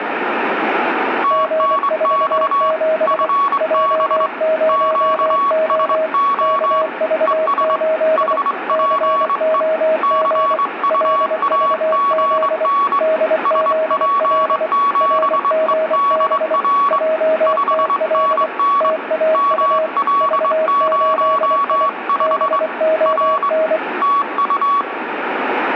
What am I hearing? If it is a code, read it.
Morse code, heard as two keyed tones, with radio static and room echo. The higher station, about 23 wpm, 1120 Hz: TNX FB QSO ES HPE CUAGN SP7EDR 5NN ML05 R TU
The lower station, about 24 wpm, 630 Hz: G47 J0O KV8 COG LVZ DZL RGB JTL TAU V8I BON